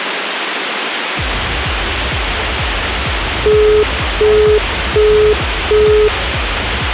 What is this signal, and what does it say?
Telephone call progress tone (as in the UK, Australia and similar networks), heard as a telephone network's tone, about 420 Hz, 0.375 s on and 0.375 s off, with phone line noise. Busy tone.